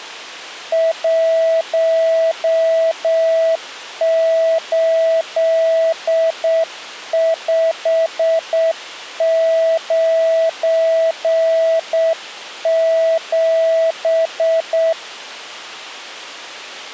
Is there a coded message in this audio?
Yes: Morse code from 0.7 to 15.0 s, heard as a keyed tone, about 7 wpm, 650 Hz. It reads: 18597